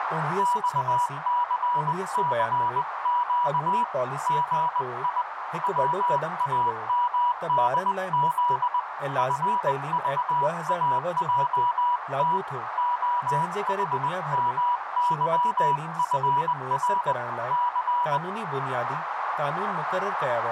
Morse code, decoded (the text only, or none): XCCQ GI WAMDZ FVAJT OHMYFR C